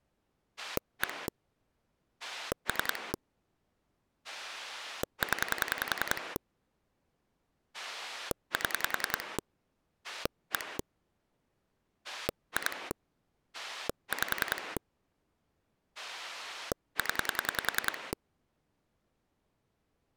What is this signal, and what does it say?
Pulse dialling, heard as a rotary dial, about 10 pulses a second. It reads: 1 3 0 7 1 2 5 0